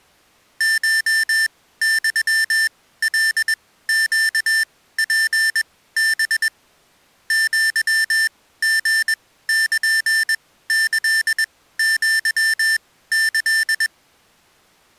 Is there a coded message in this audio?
Yes: Morse code (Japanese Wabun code) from 0.5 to 13.9 s, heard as electronic beeps, machine-sent, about 21 wpm, spaced as for 15 wpm, 1800 Hz. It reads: コユカネツハ アリルキアキ